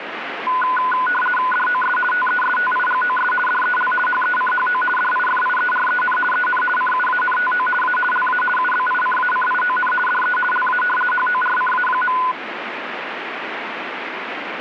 RTTY (50 baud, 450 Hz shift), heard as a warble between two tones, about 1240 Hz centre, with radio static. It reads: DOS TESTIGOS DEL HECHO DIFIEREN EN CUANTO A LA UBICACION DE LA HORCA.